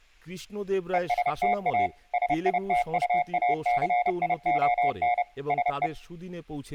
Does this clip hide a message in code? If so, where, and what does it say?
Yes: Morse code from 0.9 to 5.9 s, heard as a keyed tone, machine-sent, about 30 wpm, 720 Hz, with speech in Bangla. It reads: ESTA SITUACION SE